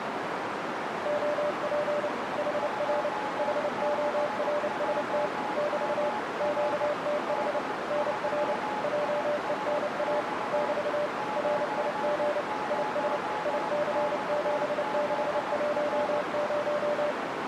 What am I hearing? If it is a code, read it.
Morse code, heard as two keyed tones, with heavy radio static and a narrow filter. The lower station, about 29 wpm, 590 Hz: OP HR HORST <BT> QTH NR JENA <BT> RIG IS IC7610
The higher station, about 18 wpm, 850 Hz: 26JMR D3ISX 90XZR